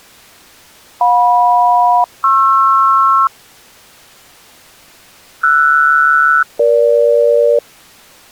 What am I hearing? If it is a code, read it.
Aircraft SELCAL, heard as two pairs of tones. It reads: JM-PR RS-EG